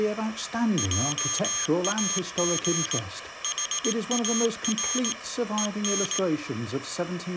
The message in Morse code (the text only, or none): JAG HAR EN